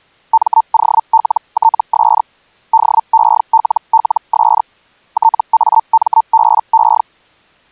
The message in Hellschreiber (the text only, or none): MOLTS DELLS TAMBE